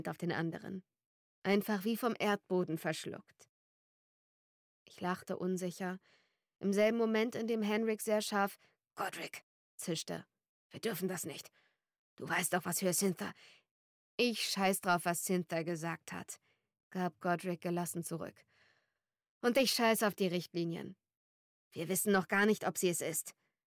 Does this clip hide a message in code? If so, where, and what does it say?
No.